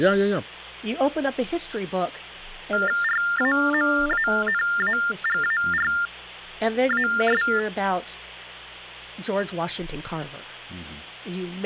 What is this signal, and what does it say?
TTY/TDD text telephone tones (45.45 baud Baudot), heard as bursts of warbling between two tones, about 400 Hz shift, 1600 Hz centre, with speech in English. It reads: RAMANAGARAS